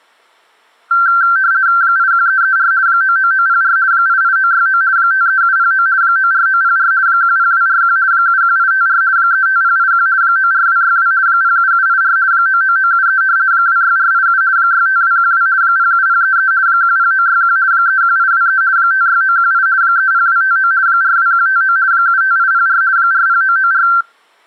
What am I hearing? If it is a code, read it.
RTTY (50 baud, 170 Hz shift), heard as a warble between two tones, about 1460 Hz centre. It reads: 81334 99904 88969 53709 94904 10241 71854 35081 94262 07784 99973 26487 65212 07033 10961 31823 56918 30259 42159 75804 40994